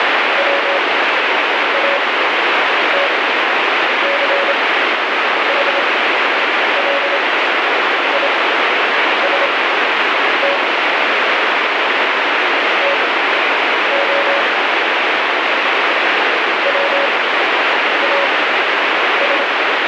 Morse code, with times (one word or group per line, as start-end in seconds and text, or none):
0.4-10.6 WATCHLIST
12.8-14.4 TO
16.7-19.4 WAS